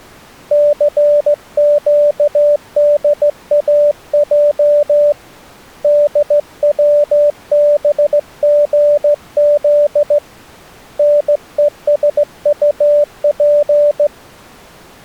Morse code, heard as a keyed tone, hand-sent with a straight key, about 15 wpm, 590 Hz. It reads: CQDAJ DWBGZ NESUP